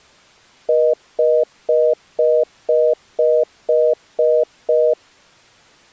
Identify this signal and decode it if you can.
Telephone call progress tone (North American plan), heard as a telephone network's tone, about 480, 620 Hz, 0.25 s on and 0.25 s off. Congestion tone.